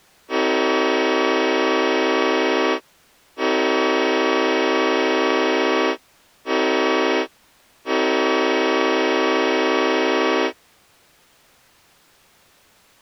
Train horn signal, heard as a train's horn. 2 long, 1 short, 1 long. On North American railways: approaching a public crossing.